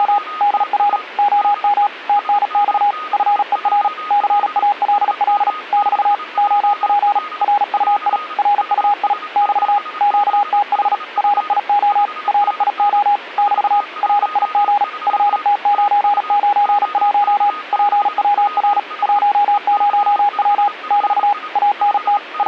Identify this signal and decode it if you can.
Morse code, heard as a keyed tone, machine-sent, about 37 wpm, 820 Hz, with a weaker station near 1240 Hz. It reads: … DR OM TNX FER CALL <BT> OP RUI RUI <BT> QTH RIO RIO <BT> RIG FT991 PWR 10W <BT> ANT …